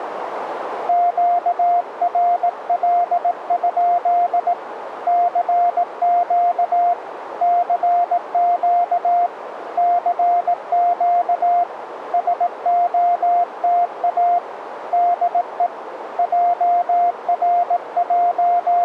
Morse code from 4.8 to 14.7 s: CQ CQ CQ SOTA

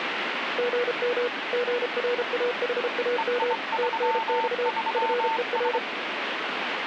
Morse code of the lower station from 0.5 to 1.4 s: GM

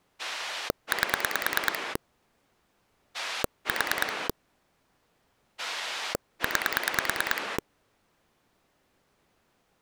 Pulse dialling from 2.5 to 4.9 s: 4

